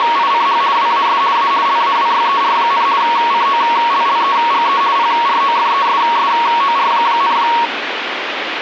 RTTY (50 baud, 170 Hz shift), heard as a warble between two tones, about 1020 Hz centre, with radio static. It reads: … WAS A LAWYER, COLLEGE PROFESSOR,